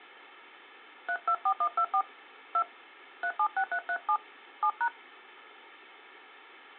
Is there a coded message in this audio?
Yes: DTMF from 1.1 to 4.9 s, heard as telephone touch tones, dialled by hand, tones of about 70 ms. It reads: 324124 2 376337 7#